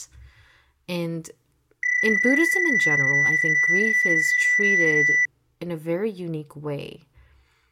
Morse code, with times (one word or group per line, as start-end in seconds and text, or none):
none